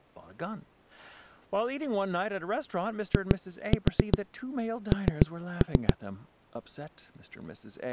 Tap code, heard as knocks on a wall, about 7 knocks a second, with speech in English. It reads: IN